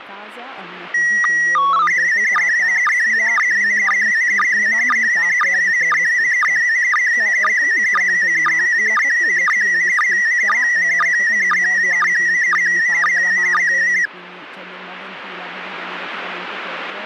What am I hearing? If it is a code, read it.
SSTV (slow-scan television), PD 120, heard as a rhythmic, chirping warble, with speech in Italian.